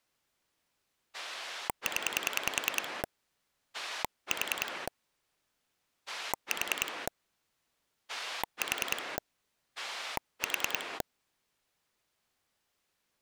Pulse dialling, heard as a rotary dial, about 10 pulses a second. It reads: 0 4 4 4 4